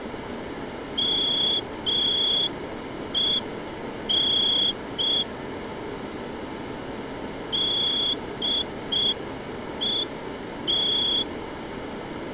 Morse code, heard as a whistle, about 5 wpm. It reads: MEN DET